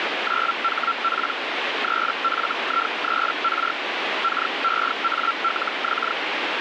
Hellschreiber (Feld-Hell, 122.5 baud), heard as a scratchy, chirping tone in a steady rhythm, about 1360 Hz, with radio static. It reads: 9HP 3FI3R KEALX